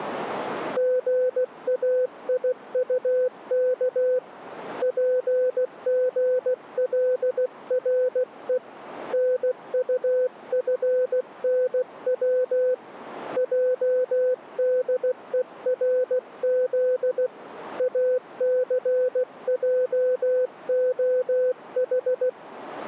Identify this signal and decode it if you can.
Morse code, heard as a keyed tone, hand-sent with a paddle, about 16 wpm, 510 Hz. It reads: GAIUK PGLRE NUFNW JDERZ ACJOH